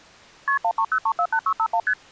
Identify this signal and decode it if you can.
Multi-frequency trunk signalling (R1, as on North American trunks), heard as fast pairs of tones, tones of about 70 ms. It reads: KP 130348651 ST